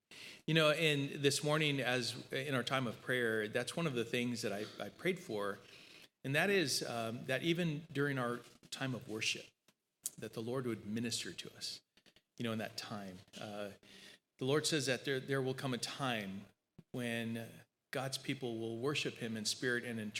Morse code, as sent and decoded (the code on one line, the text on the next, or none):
none